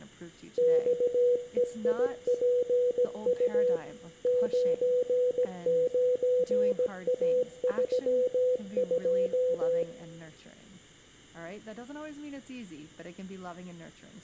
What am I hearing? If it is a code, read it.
Morse code, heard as a keyed tone, machine-sent, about 17 wpm, 500 Hz, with room echo and speech in English. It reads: XEIPU 99A32